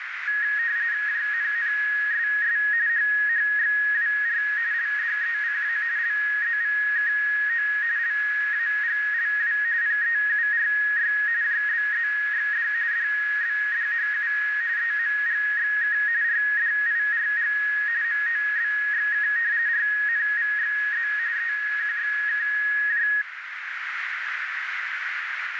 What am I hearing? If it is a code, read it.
RTTY (45.45 baud, 170 Hz shift), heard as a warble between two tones, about 1750 Hz centre, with radio static and a narrow filter. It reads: JNNSS HHXWR LDECA LZVKO LAGLW PEURY JBZXD DBDHU EMGXK RDIRG MOBXK RNVXZ EQXKJ